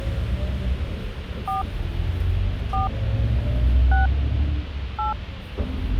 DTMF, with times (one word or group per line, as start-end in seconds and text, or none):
1.5-1.6 4
2.7-2.9 4
3.9-4.1 6
5.0-5.1 8